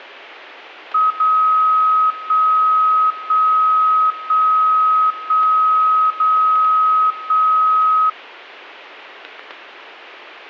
Radio time signal (DCF77), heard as a tone whose level steps once a second, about 1270 Hz. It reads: 0 1 1 1 1 0 1